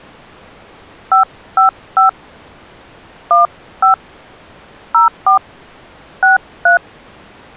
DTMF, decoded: 555 15 04 63

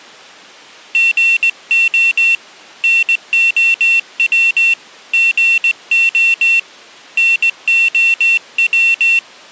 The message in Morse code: GO NOW GO NOW

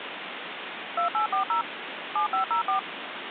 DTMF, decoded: 2840 7504

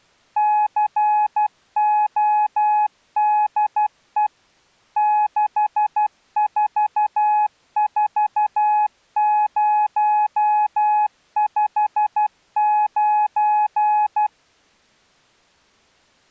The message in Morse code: CODE 644059

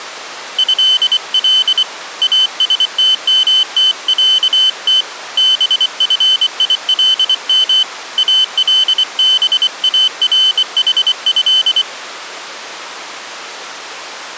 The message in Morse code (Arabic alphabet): هل استمتعت بفيلم البارحه

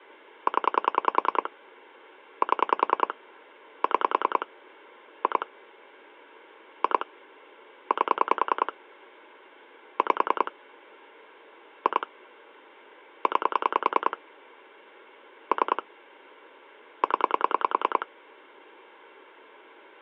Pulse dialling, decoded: 0 7 6 2 2 8 5 2 9 3 0

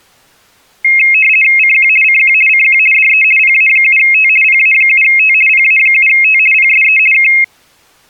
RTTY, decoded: CQ CQ CQ DE PA7T PA7T PA7T PSE K

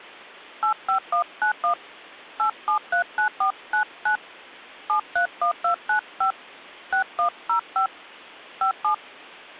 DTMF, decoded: 85191 8739499 731295 6105 57

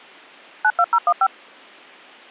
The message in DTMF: 92015

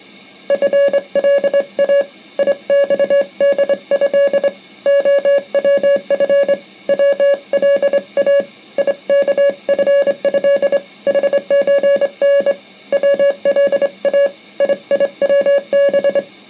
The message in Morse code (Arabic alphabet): فلا يصده خوف ولا يكفه حزن ولا ييوب

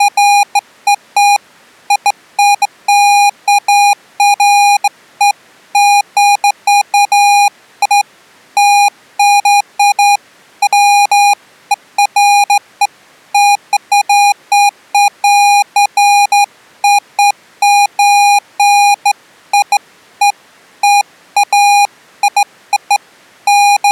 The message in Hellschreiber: none

